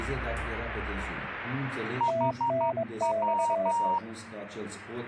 Morse code, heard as two keyed tones. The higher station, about 12 wpm, 940 Hz: HW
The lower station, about 23 wpm, 660 Hz: TNX